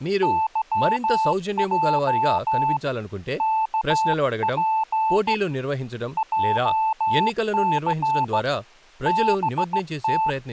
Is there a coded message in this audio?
Yes: Morse code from 0.2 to 10.4 s, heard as a keyed tone, hand-sent with a straight key, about 16 wpm, 880 Hz, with speech in Telugu. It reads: YJ KP JC BT